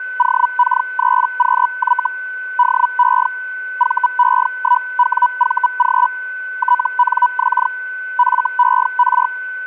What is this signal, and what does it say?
Hellschreiber (Feld-Hell, 122.5 baud), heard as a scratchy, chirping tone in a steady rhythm, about 980 Hz, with a steady whistle near 1510 Hz. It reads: OK3QY DE VE1WVG TNX FER